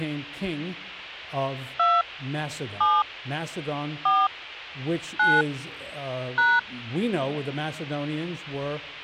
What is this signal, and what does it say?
DTMF, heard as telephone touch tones, dialled by hand, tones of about 220 ms. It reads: 2 7 4 9 #